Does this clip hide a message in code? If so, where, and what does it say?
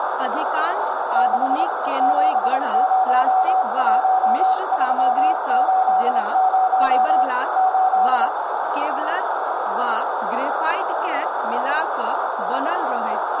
Yes: Morse code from 1.1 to 8.3 s, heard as a keyed tone, hand-sent with a bug key, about 27 wpm, 750 Hz, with radio static, a narrow filter, room echo and speech in Maithili. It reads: 6 701380 8